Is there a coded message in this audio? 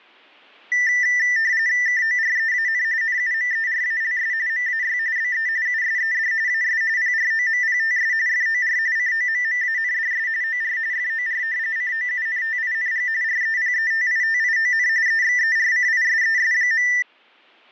Yes: RTTY (45.45 baud, 170 Hz shift) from 0.7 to 17.0 s, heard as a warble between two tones, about 1900 Hz centre. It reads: KOREAN NUMERALS MAY BE USED AS PROMPTS FOR COMMANDS OR FOR COUNTING REPETITION EXERCISES.